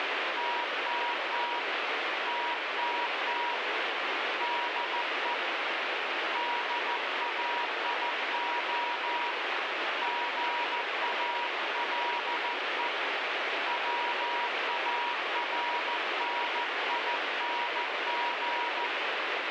Morse code, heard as a keyed tone, hand-sent with a paddle, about 14 wpm, 960 Hz, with heavy radio static. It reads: TTT TTT DE DAIO GALE WARNING